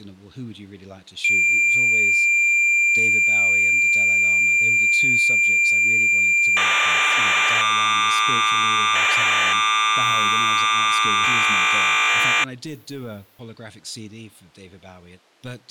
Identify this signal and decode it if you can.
Cassette data (Kansas City type), 1200 baud, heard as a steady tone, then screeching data, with speech in English.